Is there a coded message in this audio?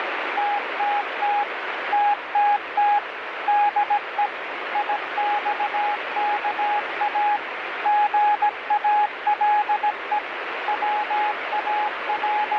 Yes: Morse code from 0.3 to 12.6 s, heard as a keyed tone, machine-sent, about 17 wpm, 830 Hz, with radio static. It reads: TTT TTT DE IXKA GALE …